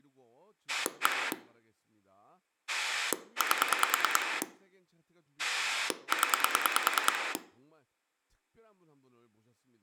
Pulse dialling, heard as a rotary dial, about 9 pulses a second, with room echo and speech in Korean. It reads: 1 8 0